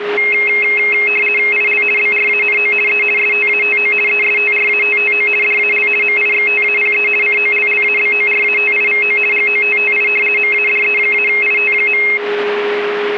RTTY (50 baud, 450 Hz shift), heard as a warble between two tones, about 2350 Hz centre, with radio static and a steady whistle near 410 Hz. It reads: IL BRANO E STATO ESTRATTO DAL MIXTAPE COLLABORATIVO GOTTI MADE-IT.